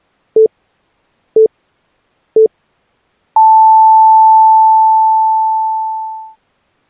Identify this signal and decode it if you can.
Radio time signal (three low pips and a long one an octave up, as on NHK), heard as pips.